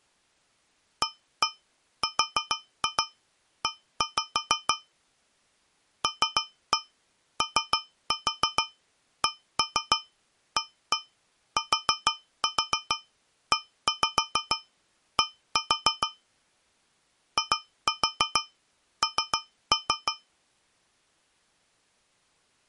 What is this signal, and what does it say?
Tap code, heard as taps on a metal pipe, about 6 knocks a second. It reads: ARE LOCATED IN